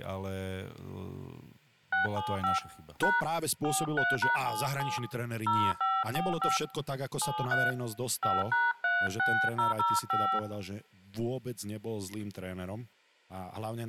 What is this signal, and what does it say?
DTMF, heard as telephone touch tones, dialled by hand, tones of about 220 ms, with speech in Slovak. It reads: 675 # 43#77 0545 73 5#36005